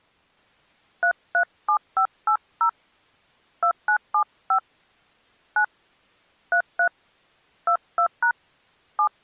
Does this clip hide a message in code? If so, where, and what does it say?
Yes: DTMF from 1.0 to 9.1 s, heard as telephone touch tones, dialled by hand, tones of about 80 ms. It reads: 337580 2975 9 33 22# 7